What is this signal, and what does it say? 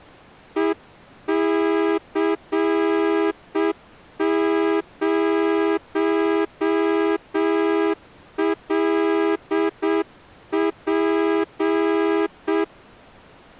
Morse code, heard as a horn, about 7 wpm. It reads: EC0LP